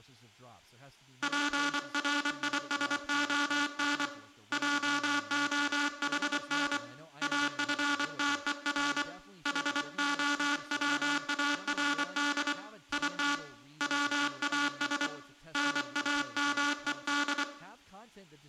Morse code, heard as a buzzer, hand-sent with a paddle, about 24 wpm, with room echo and speech in English. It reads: PRISON JOHN AFTER HOWARD IT WAS NAMED